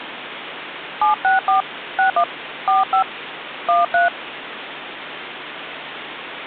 DTMF, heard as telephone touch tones, dialled by hand, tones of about 130 ms, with phone line noise. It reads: 764 61 45 13